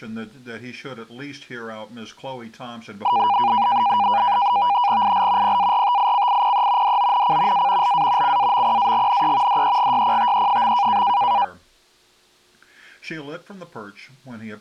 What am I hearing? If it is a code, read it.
NAVTEX (SITOR-B), 100 baud, 170 Hz shift, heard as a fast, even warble, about 890 Hz centre. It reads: IL PARTICIPE DONC A LA CAMPAGNE DEGYPTE.